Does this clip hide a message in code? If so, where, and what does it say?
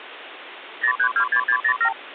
Yes: multi-frequency trunk signalling (R2, with the far end's replies) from 0.8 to 1.9 s, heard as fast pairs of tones, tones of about 80 ms, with phone line noise. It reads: 0326607